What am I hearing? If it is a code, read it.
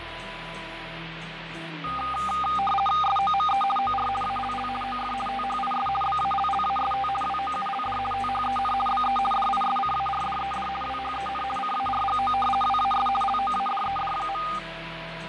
RTTY (50 baud, 450 Hz shift), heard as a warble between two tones, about 1020 Hz centre, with radio static and fading. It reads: SOME OR ALL OF THIS BALLAST WOULD THEN BE DISCARDED WHEN CARGO WAS LOADED.